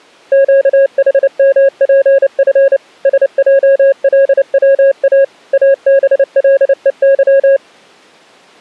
Morse code, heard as a keyed tone, machine-sent, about 29 wpm, 550 Hz. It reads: QHMPF SJLWA ABLEY